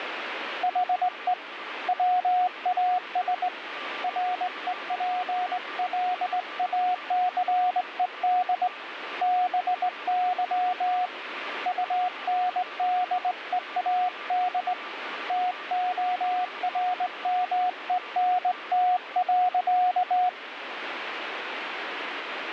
Morse code, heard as a keyed tone, hand-sent with a straight key, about 19 wpm, 730 Hz, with radio static and a weaker station near 1180 Hz. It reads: HE WAS REPLACED BY UNDEAD TORMENT.